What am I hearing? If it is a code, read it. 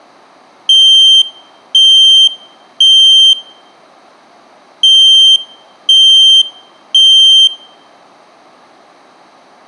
Alarm pattern, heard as an alarm's beeps, played twice, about 3150 Hz, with room echo. Temporal three. Smoke or fire, evacuate.